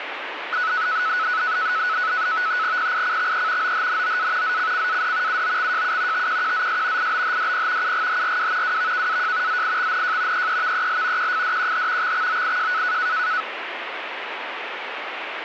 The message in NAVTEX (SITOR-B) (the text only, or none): PICXE OHNOA ZCCAD UOXJU TQQZS IBHDP UGHRW WVKAJ ZIXNJ EEVEL QFDQH XXOIJ